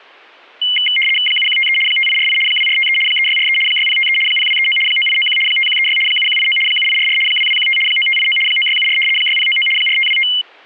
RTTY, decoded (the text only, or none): 7153 5848 2453 3643 6053 0239 9891 5136 7189 7844 2215 9589 9674 6099 4525